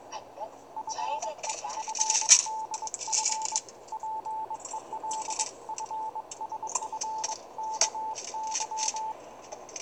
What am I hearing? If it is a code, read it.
Morse code (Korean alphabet), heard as a keyed tone, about 22 wpm, 880 Hz, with the noise inside a car. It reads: 나는 작년에